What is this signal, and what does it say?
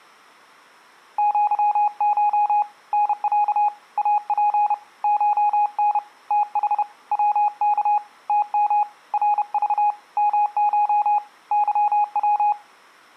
Morse code (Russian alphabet), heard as a keyed tone, hand-sent with a paddle, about 31 wpm, 830 Hz. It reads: ЪШ НЯ АП ШН ТХ ВК ТМ РЖ МШ ЫВ